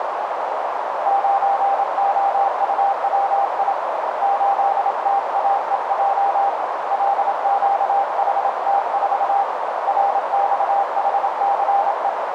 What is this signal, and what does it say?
Morse code, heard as a keyed tone, hand-sent with a paddle, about 27 wpm, 800 Hz, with heavy radio static and a narrow filter. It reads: 9OUWI 8TAEJ LQHT4 RXHCE